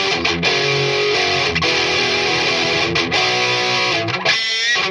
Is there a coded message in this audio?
No.